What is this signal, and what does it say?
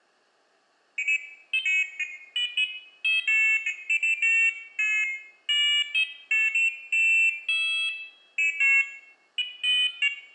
Pairs of high tones at irregular times, with room echo. There is no code.